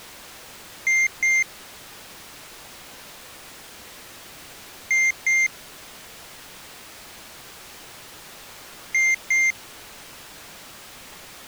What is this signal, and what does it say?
Beep code, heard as a piezo beeper, played three times, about 2100 Hz. 2 short. In AMI BIOS tables: memory parity error; in IBM BIOS tables: self-test error shown on screen; in Dell tables: no memory detected.